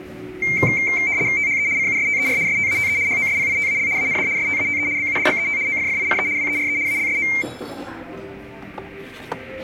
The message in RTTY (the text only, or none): THE CUSTER STATE HOSPITAL AND STATE BUDGET OFFICE WERE ALSO